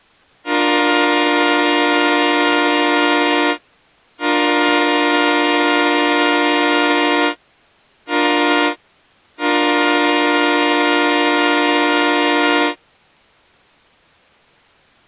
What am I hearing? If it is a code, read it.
Train horn signal, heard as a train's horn. 2 long, 1 short, 1 long. On North American railways: approaching a public crossing.